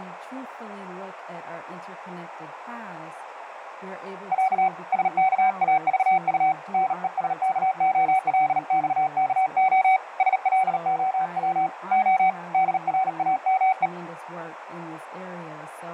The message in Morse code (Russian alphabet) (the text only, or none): Я СКАЖУ НЕСКОЛЬКО СЛОВ О ДРАМЕ